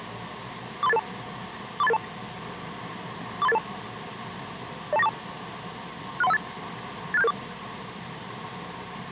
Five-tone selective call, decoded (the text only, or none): 43882 43882 43882 02942 63158 86774